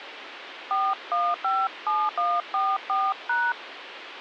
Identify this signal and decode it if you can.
DTMF, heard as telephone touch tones, dialled by hand, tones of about 230 ms, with phone line noise. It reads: 4157144#